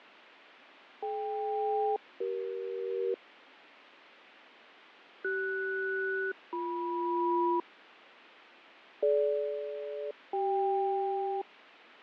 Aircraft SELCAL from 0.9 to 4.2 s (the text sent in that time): DK-CE